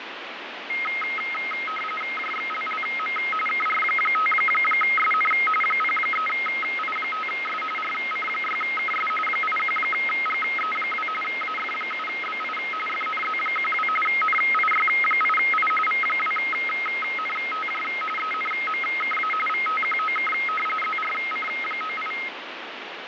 RTTY (45.45 baud, 850 Hz shift), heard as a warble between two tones, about 1700 Hz centre, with radio static and fading. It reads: JXLLM KR5SN 03I5S RC6KS 81GE2 AF7BI FNZ12 NIY8I V2NTJ ENMKA VTQOK ZRC98